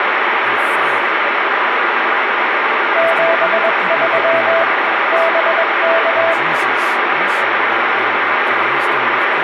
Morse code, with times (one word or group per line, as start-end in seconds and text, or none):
3.0-4.6 73
5.1-6.3 BK